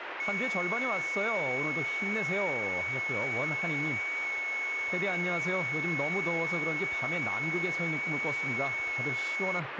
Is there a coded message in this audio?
Yes: FT8 (one signal) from 0.2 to 9.6 s, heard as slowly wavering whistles, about 6.25 baud, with radio static and speech in Korean.